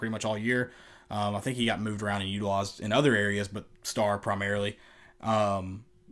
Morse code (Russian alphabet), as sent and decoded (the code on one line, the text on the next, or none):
none